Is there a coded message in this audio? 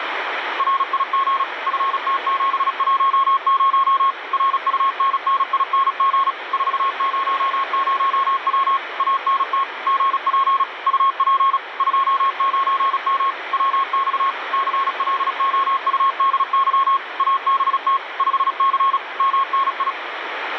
Yes: Morse code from 0.5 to 20.0 s, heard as a keyed tone, machine-sent, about 36 wpm, 1090 Hz, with radio static. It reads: RIG FT710 RUNNING 400W ANT GP UP 29M WX CLOUDY ABT 5C MNI